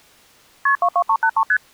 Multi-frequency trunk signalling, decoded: KP 22383 ST

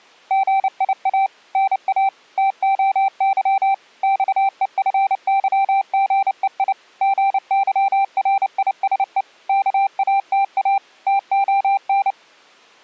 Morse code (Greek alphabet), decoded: ΓΙΑ ΝΑ ΤΟΥ ΞΕΦΥΓΕΙ ΓΥΡΙΣΕ ΚΑΤΑ ΤΟΝ

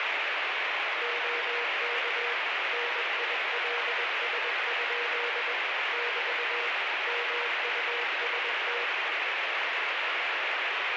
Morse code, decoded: OK NILS? <BT> MUST

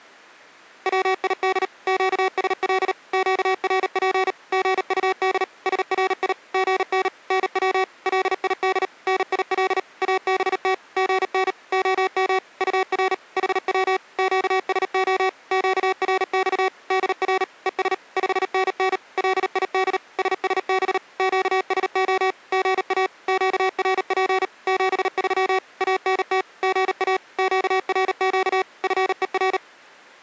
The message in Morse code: WID QSL QRP GUD SRI GN NW LID NIL ABT GN OM UR HW QSO QRX DR ES 5NN LID SSB QSO GA QRP 73 ANT GA QRQ FER

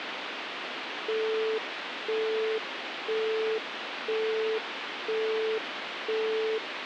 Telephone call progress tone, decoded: busy tone

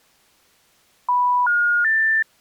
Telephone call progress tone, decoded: special information tone

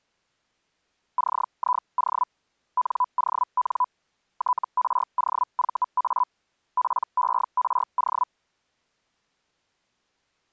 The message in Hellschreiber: CIO NON TROVA PERO

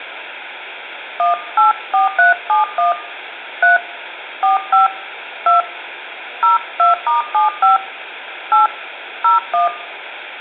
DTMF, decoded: 184371 3 45 2 02*75 8 01

